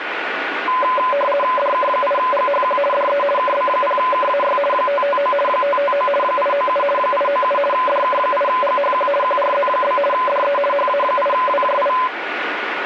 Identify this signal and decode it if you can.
RTTY (50 baud, 450 Hz shift), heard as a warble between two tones, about 790 Hz centre, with radio static. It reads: DK8GHQ DE KB0KAY 559 559 897 897 DK8GHQ QRZ? DE HA8WJI